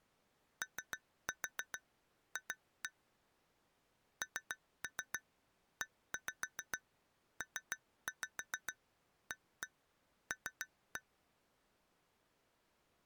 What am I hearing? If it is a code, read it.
Tap code, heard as taps on glass, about 7 knocks a second. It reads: OF NEPAL